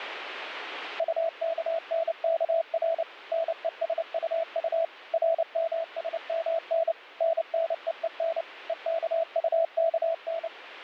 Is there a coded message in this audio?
Yes: Morse code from 0.9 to 10.5 s, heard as a keyed tone, machine-sent, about 29 wpm, 660 Hz, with radio static. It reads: UKNKR NESUU RMSMN NNEEN EKUKN